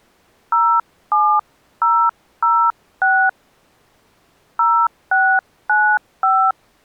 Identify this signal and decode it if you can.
DTMF, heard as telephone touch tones, dialled by hand, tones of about 280 ms. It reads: 07006 0695